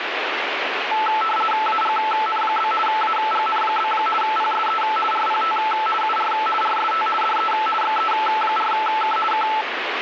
RTTY (50 baud, 450 Hz shift), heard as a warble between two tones, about 1100 Hz centre, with radio static. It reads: AGN? AGN? PSE RPT UR RST DE XE4K K